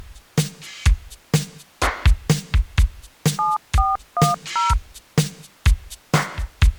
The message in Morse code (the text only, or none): none